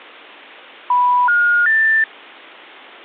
Telephone call progress tone (North American plan), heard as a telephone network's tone, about 980, 1430, 1800 Hz. Special information tone.